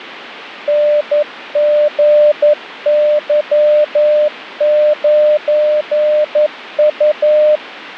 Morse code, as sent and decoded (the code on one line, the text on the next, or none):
-. --. -.-- ----. ..-
NGY9U